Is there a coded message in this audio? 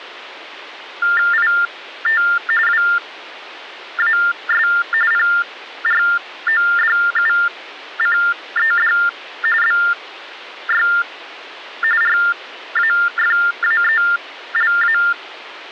Yes: TTY/TDD text telephone tones (45.45 baud Baudot) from 1.0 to 15.1 s, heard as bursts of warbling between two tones, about 400 Hz shift, 1600 Hz centre. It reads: IT WAS PRODUCED BY RAFAELA